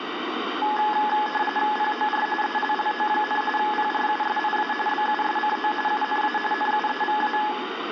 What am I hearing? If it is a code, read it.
RTTY (45.45 baud, 850 Hz shift), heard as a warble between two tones, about 1270 Hz centre, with radio static and room echo. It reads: POR ELLO, PRUSIA BUSCO UNA NUEVA